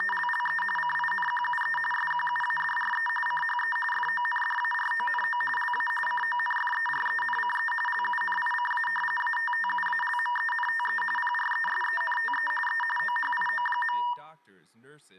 RTTY (45.45 baud, 850 Hz shift), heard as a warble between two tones, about 1390 Hz centre, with room echo and speech in English. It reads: … CINQUE SQUADRE CHE FONDARONO LA CONFERENCE LUNICA ATTUALMENTE PRESENTE E OHIO.